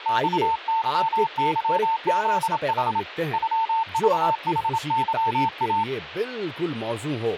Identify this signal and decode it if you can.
Morse code (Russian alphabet), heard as a keyed tone, hand-sent with a paddle, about 27 wpm, 900 Hz, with speech in Urdu. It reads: ЬЫЫЗХ ЮЖХЫА